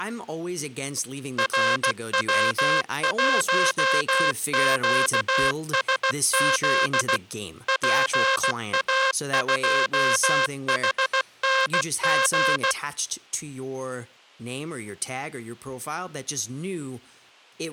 Morse code, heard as a buzzer, machine-sent, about 16 wpm, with speech in English. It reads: RW1QSZ PA2HNG